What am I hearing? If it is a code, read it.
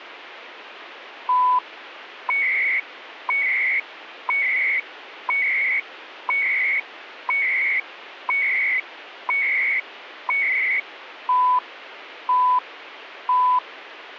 Radio time signal (CHU, Canada), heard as beeps and data bursts, one a second, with radio static.